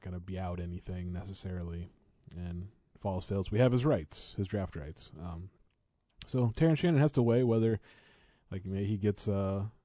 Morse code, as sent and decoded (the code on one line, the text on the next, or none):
none